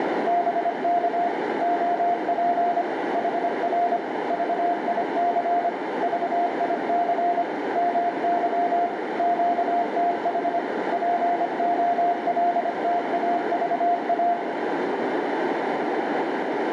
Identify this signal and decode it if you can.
Morse code, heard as a keyed tone, machine-sent, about 25 wpm, 700 Hz, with heavy radio static and a narrow filter. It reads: BK OP HR VIC VIC MY QTH POLTAVA